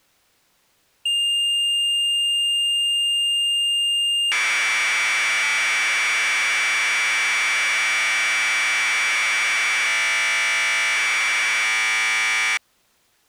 Commodore tape loading (standard loader), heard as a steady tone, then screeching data.